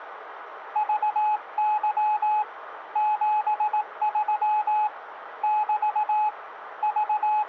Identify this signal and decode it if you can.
Morse code, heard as a keyed tone, hand-sent with a paddle, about 18 wpm, 850 Hz, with radio static. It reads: VY 73 <BT> …